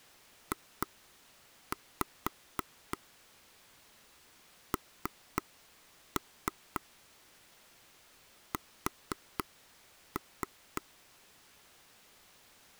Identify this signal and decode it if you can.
Tap code, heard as taps on a table, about 3 knocks a second. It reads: JNS